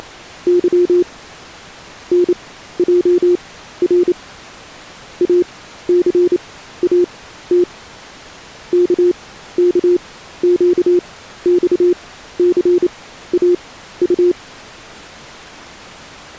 Morse code, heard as a keyed tone, machine-sent, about 28 wpm, spaced as for 14 wpm, 350 Hz. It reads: … NJR ACAT KKQXCAU